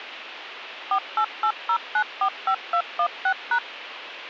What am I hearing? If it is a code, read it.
DTMF, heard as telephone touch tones, dialled by machine, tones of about 80 ms, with phone line noise. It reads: 4880945216#